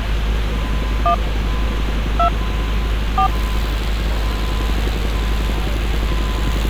DTMF, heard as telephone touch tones, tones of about 90 ms, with street noise. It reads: 1 2 4